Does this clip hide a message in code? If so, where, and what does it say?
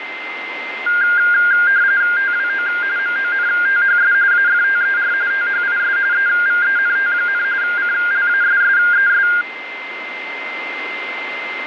Yes: RTTY (45.45 baud, 170 Hz shift) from 0.9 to 9.4 s, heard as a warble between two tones, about 1500 Hz centre, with radio static and a steady whistle near 2080 Hz. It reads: TWO MONTHS AFTER THIS EVENT, CLASSES